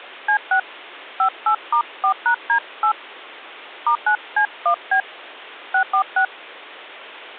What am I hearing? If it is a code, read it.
DTMF, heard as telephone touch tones, dialled by hand, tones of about 90 ms. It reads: C6 58*4#D8 *9C1B 646